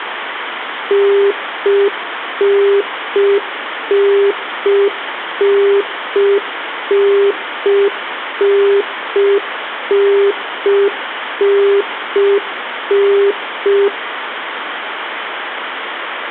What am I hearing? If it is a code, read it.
Telephone call progress tone (UK plan), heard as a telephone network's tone, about 400 Hz, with phone line noise and room echo. Congestion tone.